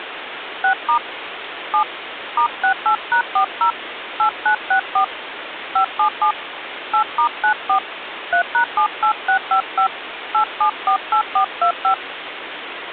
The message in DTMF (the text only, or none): 6* 7 *68#40 8964 577 8*94 3#78655 8748425